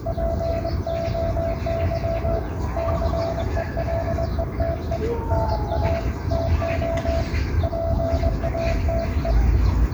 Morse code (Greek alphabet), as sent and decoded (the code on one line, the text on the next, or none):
.--. --- -.-- / -.-. . .-.. . - . / -. .- / - --- / .--. .- - .
ΠΟΥ ΘΕΛΕΤΕ ΝΑ ΤΟ ΠΑΤΕ